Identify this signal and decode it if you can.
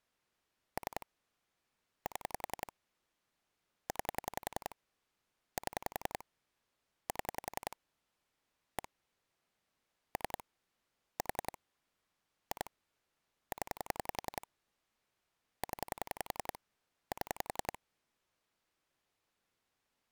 Pulse dialling, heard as clicks on a phone line, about 10 pulses a second. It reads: 3 7 9 7 7 1 3 4 2 0 0 7